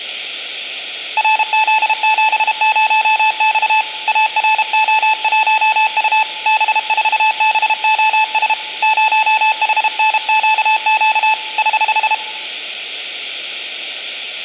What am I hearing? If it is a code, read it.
Morse code, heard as a keyed tone, hand-sent with a paddle, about 32 wpm, 870 Hz, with room echo. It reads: RZ70X ARO1U B4BOS 0HNQQ <HH>